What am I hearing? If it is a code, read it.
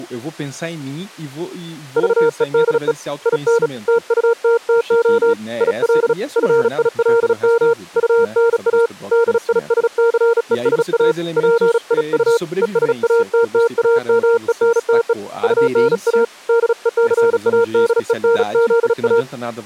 Morse code, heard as a keyed tone, hand-sent with a bug key, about 36 wpm, 460 Hz, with speech in Portuguese. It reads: VEDE IN TUTTO IL FILM UNA DISCESA PIU ESATTAMENTE UNA DECADENZA